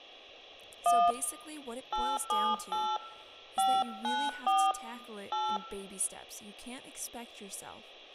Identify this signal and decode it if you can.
DTMF, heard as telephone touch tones, dialled by hand, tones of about 240 ms, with room echo and speech in English. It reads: 1 878 594 8